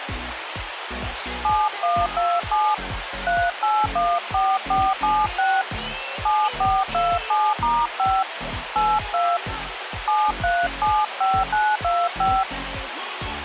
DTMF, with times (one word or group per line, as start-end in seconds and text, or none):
1.4-2.7 7127
3.3-5.6 3814476
6.3-8.2 7427*5
8.8-9.4 82
10.1-12.4 7375925